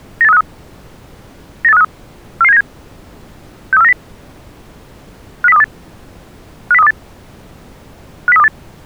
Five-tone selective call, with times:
0.2-0.4 98353
1.6-1.8 98353
2.4-2.6 44797
3.7-3.9 63490
5.4-5.6 50328
6.7-6.9 50328
8.3-8.5 50328

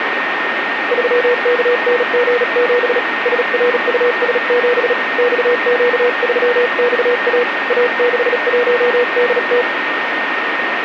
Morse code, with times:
0.9-3.0 3KNG7
3.3-4.9 SRUS7
5.2-7.4 XQ3XA
7.7-9.6 A61DT

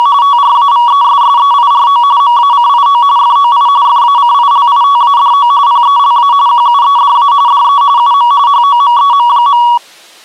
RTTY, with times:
0.0-0.1 …
0.2-2.0 TRAVESSEIRO
2.2-3.0 MACIO
3.2-3.7 FOI
3.9-5.5 FACILITADO
5.7-6.3 PELA
6.5-7.3 QUEDA
7.5-7.8 DE
8.0-8.3 UM
8.5-9.6 HOMEM.

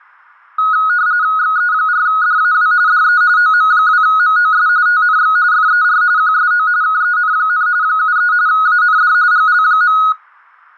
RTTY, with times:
1.4-2.7 XE4DAW
2.9-3.2 DE
3.4-4.7 OM2MOS
4.9-5.4 TNX
5.5-6.0 FER
6.2-6.7 QSO
6.8-7.7 KEN,
7.8-8.3 73
8.5-9.1 AND
9.3-10.0 GL.

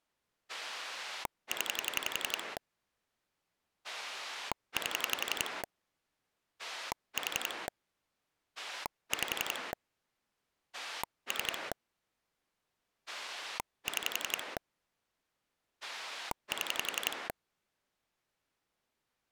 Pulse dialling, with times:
0.5-2.6 0
3.8-5.6 8
6.6-7.7 4
8.6-9.7 5
10.7-11.7 3
13.1-14.6 6
15.8-17.3 7

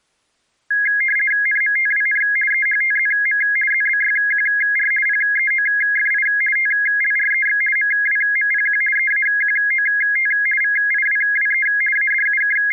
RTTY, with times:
1.5-2.2 NMTWN
2.5-3.4 EHTZM
3.7-4.9 ZBYQR
5.1-6.3 PEOFI
6.6-7.6 TLREX
7.8-8.8 MWMPQ
9.0-10.3 EAQOT
10.6-11.7 VIWWE
12.0-12.7 …

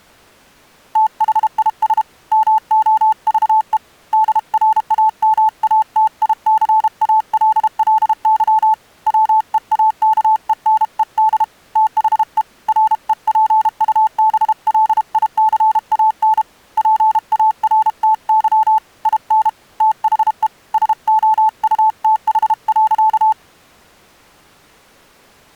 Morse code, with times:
1.0-2.0 THIS
2.3-3.8 MOVE
4.1-8.7 DRAMATICALLY
9.1-11.4 WEAKENED
11.8-12.4 THE
12.7-16.4 REPUBLICAN
16.8-18.8 PARTY
19.1-19.5 IN
19.8-20.5 THE
20.7-23.3 SOUTH.

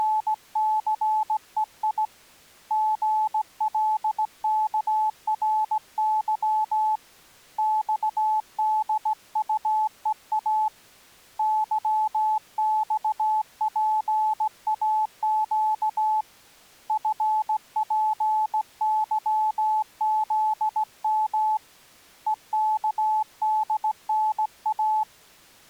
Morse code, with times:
0.0-2.0 …
2.7-7.0 GLKRY
7.6-10.7 XDUEA
11.4-16.2 YXPAQ
16.9-21.6 FPYZM
22.3-25.0 EKDNA

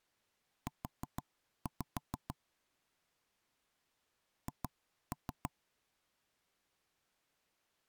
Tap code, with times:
0.7-2.3 U
4.5-5.5 H

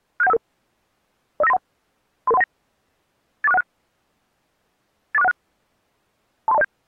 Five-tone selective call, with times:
0.2-0.4 67155
1.4-1.6 05931
2.3-2.4 33319
3.4-3.6 84616
5.1-5.3 84616
6.5-6.6 23207

